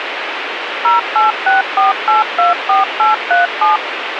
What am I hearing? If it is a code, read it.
DTMF, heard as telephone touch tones, dialled by machine, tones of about 150 ms, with radio hiss and a squelch burst at the end. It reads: 0864824837